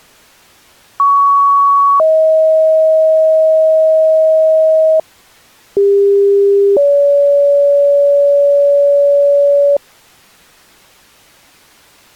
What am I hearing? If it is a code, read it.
Two-tone page, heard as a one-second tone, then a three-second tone, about 1120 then 630 Hz, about 400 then 570 Hz.